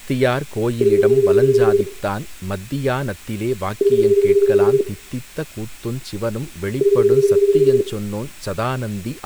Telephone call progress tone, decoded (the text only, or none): ringback tone